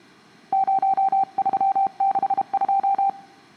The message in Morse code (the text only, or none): 0362